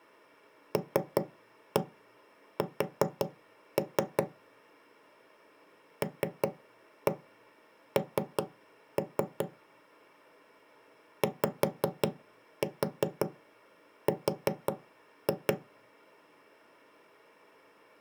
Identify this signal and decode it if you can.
Tap code, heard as knocks on wood, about 5 knocks a second. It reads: LS LN YR